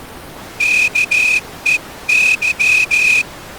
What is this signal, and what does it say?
Morse code, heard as a whistle, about 14 wpm. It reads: KEY